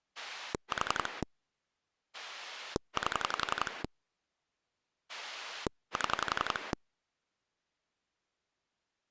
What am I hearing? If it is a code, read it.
Pulse dialling, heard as a rotary dial, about 11 pulses a second. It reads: 4 8 7